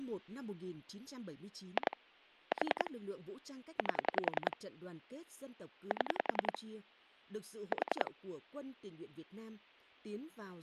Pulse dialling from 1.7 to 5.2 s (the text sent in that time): 2 4 8